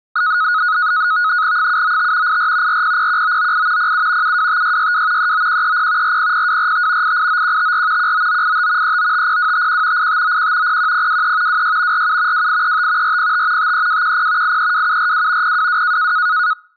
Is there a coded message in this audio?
Yes: NAVTEX (SITOR-B), 100 baud, 170 Hz shift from 0.2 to 16.5 s, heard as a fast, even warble, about 1360 Hz centre. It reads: 795 84 4001998 07 725662 39130 400245 889154 19985 3950251 8591 01023 26 47 2835 405 53210 832742 022